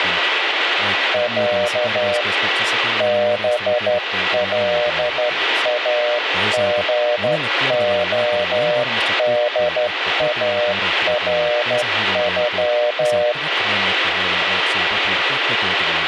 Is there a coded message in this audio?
Yes: Morse code (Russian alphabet) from 1.1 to 13.4 s, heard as a keyed tone, hand-sent with a straight key, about 12 wpm, 600 Hz, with radio static and speech in Finnish. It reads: Я БЛАГОДАРЮ